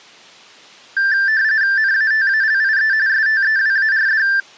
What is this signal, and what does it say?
RTTY (45.45 baud, 170 Hz shift), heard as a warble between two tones, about 1650 Hz centre. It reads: NATALIE STEWARD